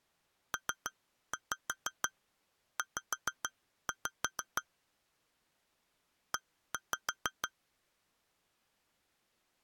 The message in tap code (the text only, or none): PZ E